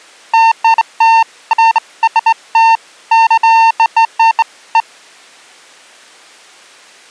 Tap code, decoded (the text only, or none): none